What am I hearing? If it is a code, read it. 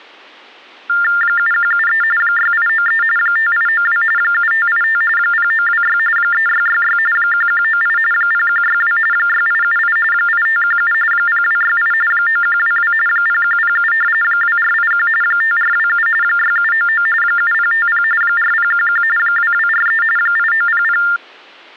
TTY/TDD text telephone tones (45.45 baud Baudot), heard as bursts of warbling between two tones, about 400 Hz shift, 1600 Hz centre. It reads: 7173 6893 5892 7585 0926 3666 1198 0162 6878 8517 0268 9122 0107 2481 5427 6799 7050 4011 2243 8900